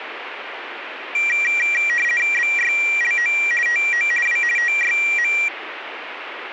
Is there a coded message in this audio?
Yes: RTTY (50 baud, 450 Hz shift) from 1.1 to 5.5 s, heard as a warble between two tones, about 2150 Hz centre, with radio static. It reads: BYLO TO W TYM